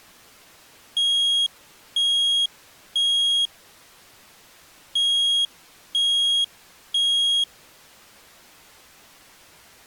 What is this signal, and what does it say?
Alarm pattern, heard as an alarm's beeps, played twice, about 3300 Hz. Temporal three. Smoke or fire, evacuate.